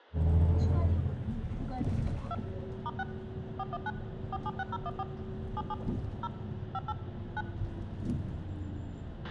DTMF, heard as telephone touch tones, dialled by machine, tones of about 40 ms, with a squelch burst at the end and the noise inside a bus. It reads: 2 *6 419 476014 77 0 58 9